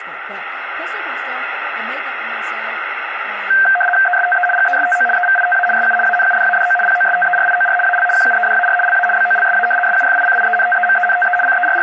RTTY (75 baud, 850 Hz shift), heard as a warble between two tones, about 1140 Hz centre, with radio static and speech in English. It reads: ESTE GESTO EVITA SU ANUDADO POSTERIOR AL QUEDAR LA BOLSA SUFICIENTEMENTE …